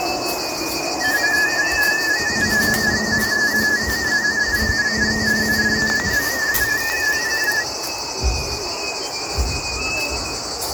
Multi-tone FSK (Olivia or MFSK type), about 250 Hz wide, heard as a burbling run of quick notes, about 31.25 baud.